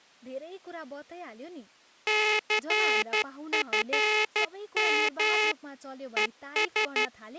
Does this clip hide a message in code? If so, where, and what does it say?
Yes: Morse code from 2.0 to 7.1 s, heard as a buzzer, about 12 wpm, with speech in Nepali. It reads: CFM ES